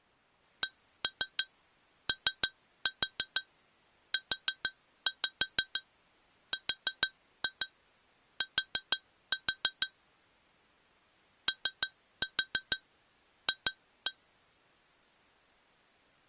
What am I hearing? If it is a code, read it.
Tap code, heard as taps on glass, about 6 knocks a second. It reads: COURT OF